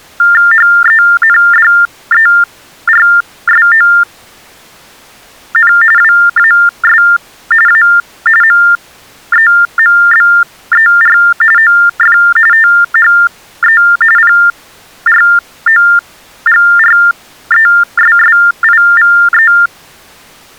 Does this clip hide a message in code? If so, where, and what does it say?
Yes: TTY/TDD text telephone tones (45.45 baud Baudot) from 0.2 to 19.7 s, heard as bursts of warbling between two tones, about 400 Hz shift, 1600 Hz centre. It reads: HENDERSON WAS A MEMBER OF THE PROGRESSIVE